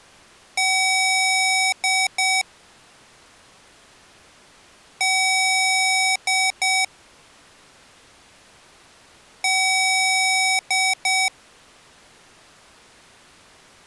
Beep code, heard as beeps from a small speaker, played three times, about 760 Hz. 1 long, 2 short. In Award, IBM and AMI BIOS tables: video adapter failure.